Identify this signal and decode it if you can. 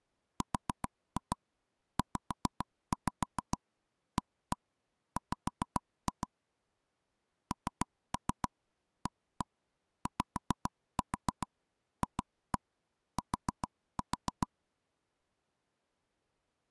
Tap code, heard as taps on a table, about 7 knocks a second. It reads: RZAW NAYFT